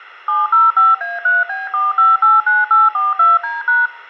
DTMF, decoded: 705A3B4589842D#

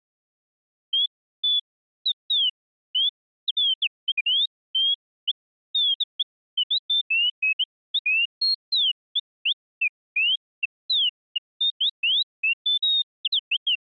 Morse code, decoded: none

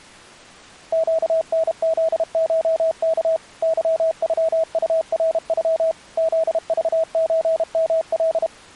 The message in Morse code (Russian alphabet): ЩНЗШК ЫЮУРЮ ЗЖЧМЛ

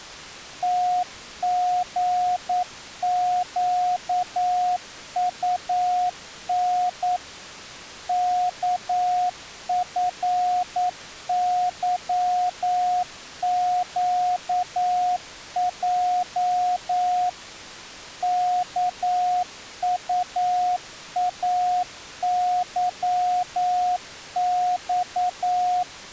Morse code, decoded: TGQUN KFYQJ KUAYX

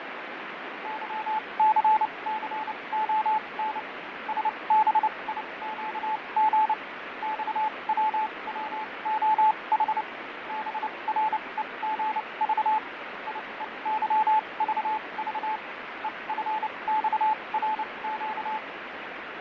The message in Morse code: YCCON SBIQG XWWOH BREGV IEYVV EFXRQ

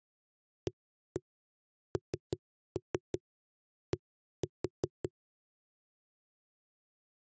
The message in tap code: AND

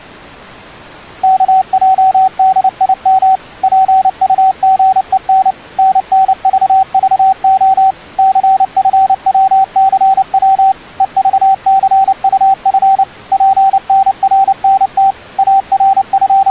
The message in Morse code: KJDIM PUGEN NNVVO CFWCW EVCUF PNRNT …

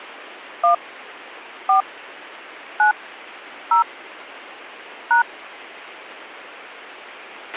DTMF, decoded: 1 4 9 0 #

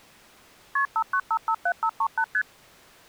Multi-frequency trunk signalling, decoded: KP 59557538 ST

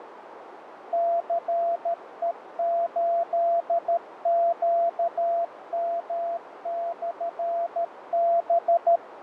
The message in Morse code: CE8QM/B

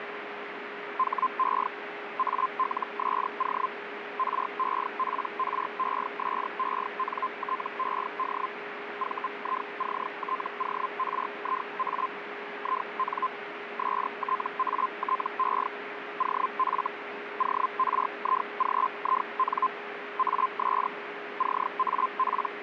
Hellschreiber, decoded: HE ALSO REPRESENTED VICTORIA IN STATE OF ORIGIN AS …

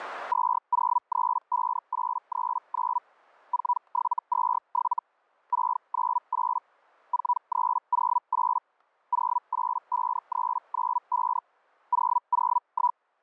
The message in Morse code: none

